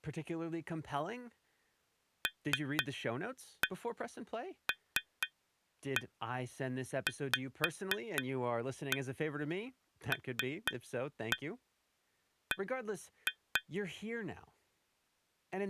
Tap code, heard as taps on glass, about 4 knocks a second, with speech in English. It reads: LLVLB